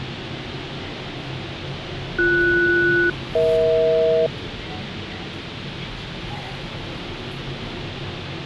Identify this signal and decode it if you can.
Aircraft SELCAL, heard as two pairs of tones, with the noise inside a lift. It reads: BS-EH